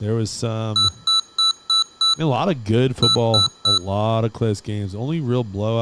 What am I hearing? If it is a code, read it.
Beep code, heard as beeps from a small speaker, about 1320 Hz, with speech in English. 5-3.